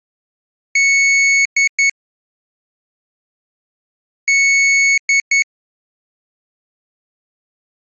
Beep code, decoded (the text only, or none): 1 long, 2 short